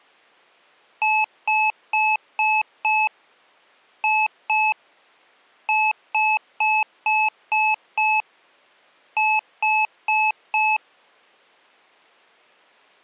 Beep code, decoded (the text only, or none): 5-2-6-4